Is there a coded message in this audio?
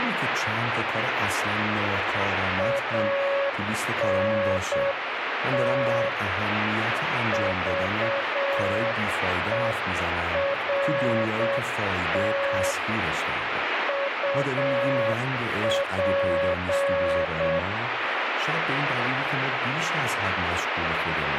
Yes: Morse code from 2.5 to 17.7 s, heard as a keyed tone, hand-sent with a paddle, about 7 wpm, 560 Hz, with heavy radio static and speech in Persian. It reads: ANT VERT UP